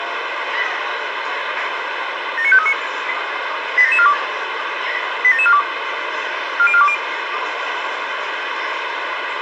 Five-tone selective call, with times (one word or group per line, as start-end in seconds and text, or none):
2.4-2.7 79539
3.8-4.1 87742
5.2-5.6 87742
6.6-6.9 40420